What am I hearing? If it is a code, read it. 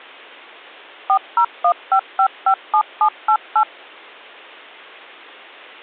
DTMF, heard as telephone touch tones, dialled by machine, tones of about 80 ms. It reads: 4015557788